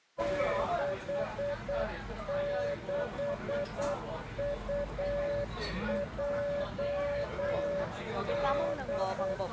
Morse code, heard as a keyed tone, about 8 wpm, 570 Hz, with the noise of a restaurant. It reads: 66UJD